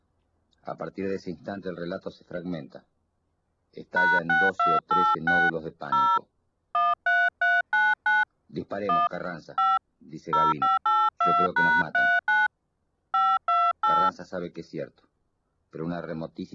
DTMF, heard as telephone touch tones, dialled by hand, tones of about 210 ms. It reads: #6286 0 13399 1 5 0582#39 528